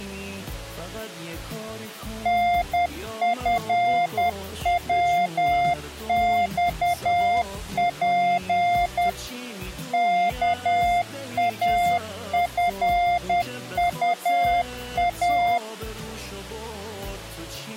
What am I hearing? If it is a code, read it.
Morse code, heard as a keyed tone, machine-sent, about 10 wpm, 700 Hz. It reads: NFWXP KAFUA